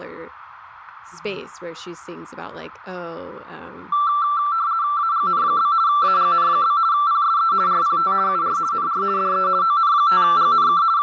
RTTY (50 baud, 170 Hz shift), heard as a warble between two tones, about 1250 Hz centre, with radio static, fading, room echo and speech in English. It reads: AGN? AGN? PSE RPT UR NR DE ON5GNK …